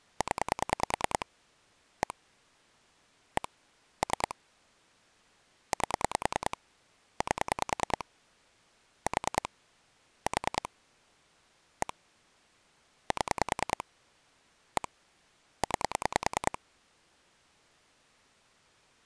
Pulse dialling, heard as clicks on a phone line, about 10 pulses a second. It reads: 0 1 1 3 8 8 4 4 1 7 1 9